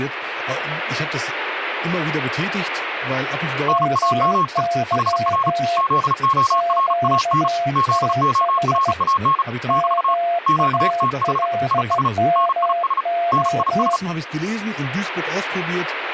Morse code, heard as two keyed tones, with radio static and speech in German. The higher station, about 35 wpm, 1090 Hz: NAME HR ZORAN ZORAN <BT> QTH IS NIS NIS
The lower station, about 16 wpm, 690 Hz: MY QTH MALMO